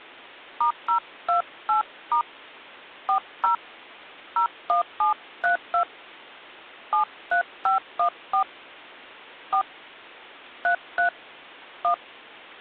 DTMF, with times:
0.6-2.2 *028*
3.1-3.5 40
4.4-5.8 01732
6.9-8.4 73514
9.5-9.6 4
10.6-11.1 33
11.8-11.9 1

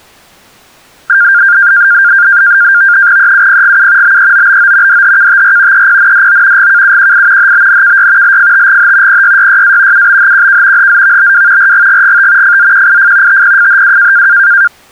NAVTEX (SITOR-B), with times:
3.2-4.2 EUPGU
4.0-5.0 BEOBO
4.9-5.9 DHKTR
5.7-6.7 EPNDO
6.6-7.5 GKUQI
7.4-8.4 HBNKY
8.2-9.2 LFTGH
9.1-10.1 PYYYA
9.9-10.9 UBHQK
10.8-11.7 HZVBW
11.6-12.6 RGGGT
12.4-13.4 FZQIF
13.3-14.3 TPFHW

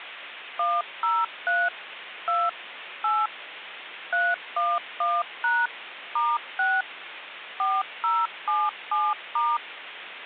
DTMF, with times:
0.6-1.7 103
2.3-2.5 2
3.0-3.3 8
4.1-5.7 311#
6.2-6.8 *6
7.6-9.6 4077*

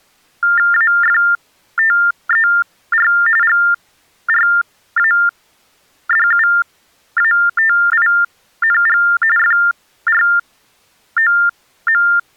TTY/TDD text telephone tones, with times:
0.7-3.1 AFTER
3.4-9.0 GRADUATING
9.4-12.0 FROM

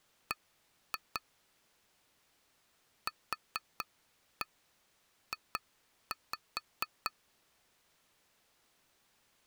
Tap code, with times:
0.3-1.2 B
3.1-7.1 QJ

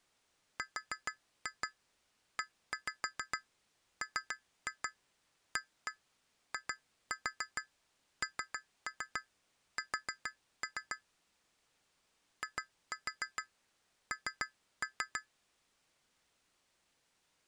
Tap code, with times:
0.6-11.0 REMAINS
12.4-15.2 IN

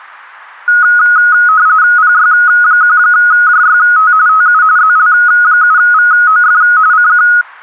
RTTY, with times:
2.0-4.1 PY1JYT
4.3-4.6 TU
4.8-6.6 ZL7VOF
6.9-7.3 CQ

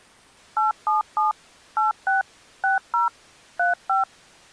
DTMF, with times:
0.6-1.3 877
1.8-2.2 86
2.6-3.1 60
3.6-4.0 35

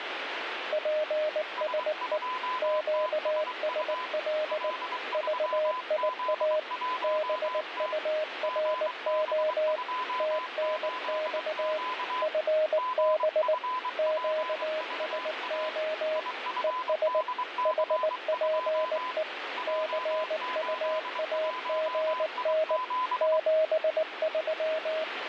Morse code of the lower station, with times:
0.7-2.2 PSE
2.6-4.7 QSL
5.1-6.6 VIA
7.0-9.8 BURO
10.2-11.8 TNX
12.2-13.5 FB
14.0-16.2 QSO
16.6-17.2 ES
17.7-19.2 HPE
19.7-22.8 CUAGN
23.2-25.0 73

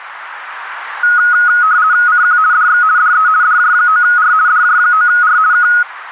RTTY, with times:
2.1-2.4 CQ
2.5-2.8 DX
3.0-3.3 DE
3.4-4.3 DJ9R
4.5-5.4 DJ9R
5.5-5.7 K

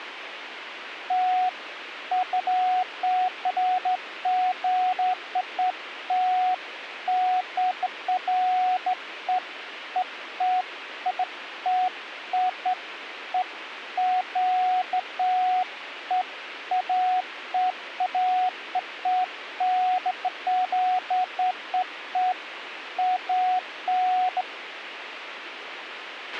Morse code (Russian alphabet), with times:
none

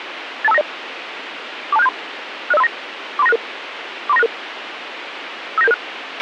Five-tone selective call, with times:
0.4-0.6 82590
1.7-1.9 42673
2.5-2.7 60539
3.2-3.4 43966
4.1-4.3 43966
5.6-5.7 59776

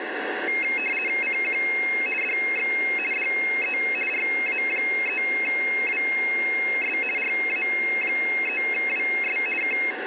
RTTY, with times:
1.2-1.6 CQ
2.2-2.7 DX
3.1-3.8 DE
4.1-7.0 RA3WS
7.2-9.4 RA3WS
9.6-9.8 K

